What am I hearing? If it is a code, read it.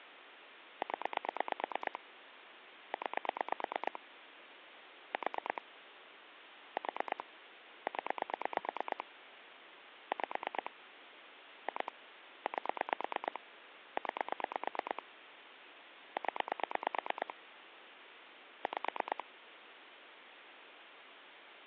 Pulse dialling, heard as clicks on a phone line, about 9 pulses a second, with phone line noise. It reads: 0 9 4 4 0 5 2 8 9 0 5